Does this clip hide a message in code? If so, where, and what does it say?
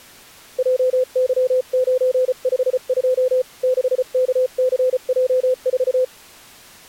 Yes: Morse code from 0.5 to 6.1 s, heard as a keyed tone, hand-sent with a paddle, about 34 wpm, 510 Hz. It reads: JY952 6KCJ4